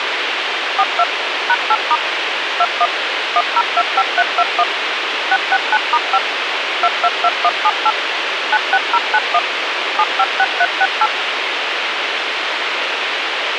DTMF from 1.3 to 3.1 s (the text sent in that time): #8* 21